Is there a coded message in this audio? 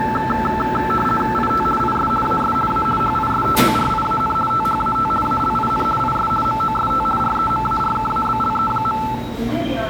Yes: RTTY (50 baud, 450 Hz shift) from 0.0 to 9.2 s, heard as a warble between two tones, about 1100 Hz centre, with room echo and the noise of a subway station. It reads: IT IS AS A HISTORIAN THAT ALIN IS MOST REMARKABLE.